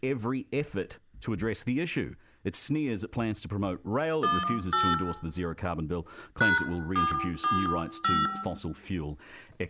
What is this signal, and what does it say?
DTMF, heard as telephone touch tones, dialled by hand, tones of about 240 ms, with room echo and speech in English. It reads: 18 #445